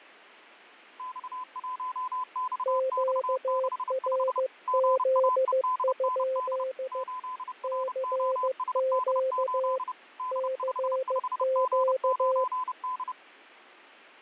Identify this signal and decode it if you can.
Morse code, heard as two keyed tones, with fading. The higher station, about 30 wpm, 1010 Hz: X1XX65 GAEDND 8ROSD8 D55G9D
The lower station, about 15 wpm, 520 Hz: QRZ? CQ CQ